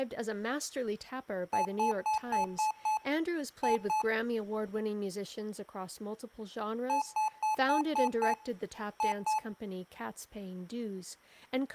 Beep code, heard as beeps from a small speaker, played twice, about 860 Hz, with room echo and speech in English. 6-2.